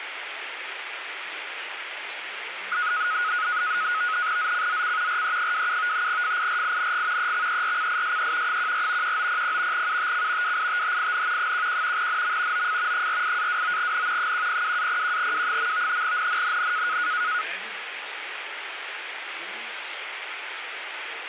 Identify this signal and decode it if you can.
NAVTEX (SITOR-B), 100 baud, 170 Hz shift, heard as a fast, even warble, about 1360 Hz centre, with radio static. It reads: ZCZC RE27 FIRING EXERCISE 14 1900 UTC WITHIN 11 NM OF 48-29N 102-01W. NNNN